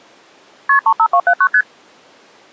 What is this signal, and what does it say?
Multi-frequency trunk signalling (R1, as on North American trunks), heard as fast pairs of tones, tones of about 70 ms. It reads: KP 35279 ST